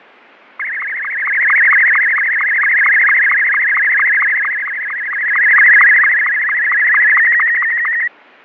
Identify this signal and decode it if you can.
SSTV (slow-scan television), Martin M2, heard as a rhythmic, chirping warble, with fading.